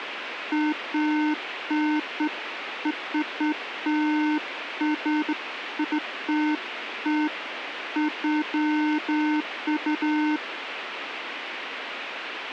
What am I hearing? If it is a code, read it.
Beeps of irregular length, with radio hiss. There is no code.